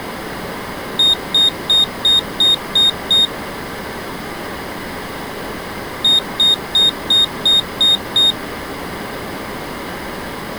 Beep code, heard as a piezo beeper, played twice, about 3700 Hz. 7 short. In AMI BIOS tables: virtual mode exception error; in Dell tables: processor failure.